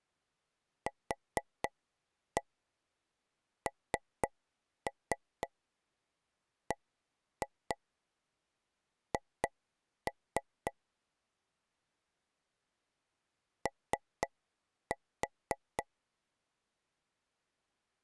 Tap code, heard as taps on a table, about 4 knocks a second. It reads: QNBH O